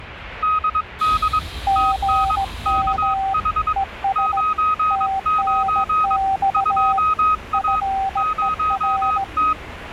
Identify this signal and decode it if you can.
Morse code, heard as two keyed tones, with the noise inside a subway train. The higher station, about 22 wpm, 1260 Hz: DD TN KH 99 2A 0T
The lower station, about 17 wpm, 780 Hz: GM ES TNX FER